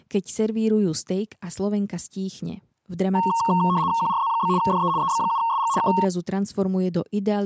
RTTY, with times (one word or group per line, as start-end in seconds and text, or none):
4.0-4.5 QRZ?
4.6-4.9 DE
5.0-5.7 EB7SG
5.8-5.9 K